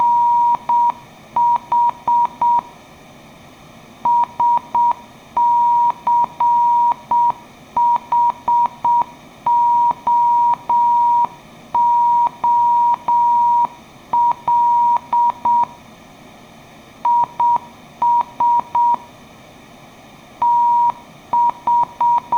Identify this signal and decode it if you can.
Morse code, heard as a keyed tone, hand-sent with a straight key, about 7 wpm, 950 Hz. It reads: … SCHOOL IS …